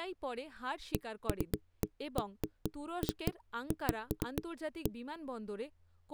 Irregular knocks on a wall, with speech in Bangla. There is no code.